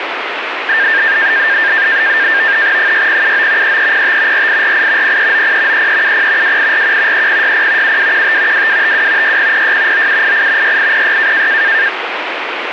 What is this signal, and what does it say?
NAVTEX (SITOR-B), 100 baud, 170 Hz shift, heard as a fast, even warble, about 1700 Hz centre, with radio static. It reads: 6079 3305 4848 0390 3370 2841 3060 7215 2252 6006 9788 6806